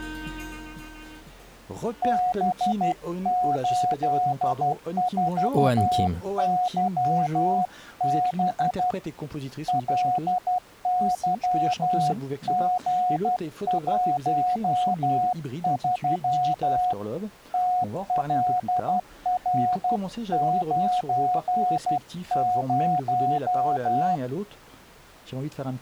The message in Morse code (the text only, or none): B84YB LYG13 TLR90